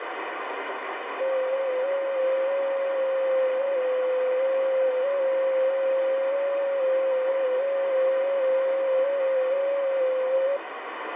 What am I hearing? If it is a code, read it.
FT8 (one signal), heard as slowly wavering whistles, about 6.25 baud, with radio static.